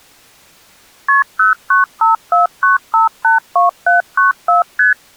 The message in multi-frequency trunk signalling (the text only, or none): KP 09549582794 ST